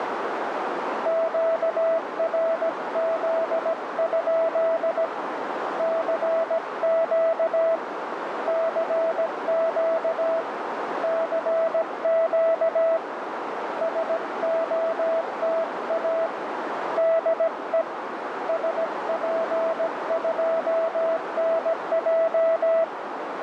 Morse code, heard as a keyed tone, hand-sent with a paddle, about 17 wpm, 660 Hz, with heavy radio static and a narrow filter. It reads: QRZ? CQ CQ CQ SOTA DE SP2NJ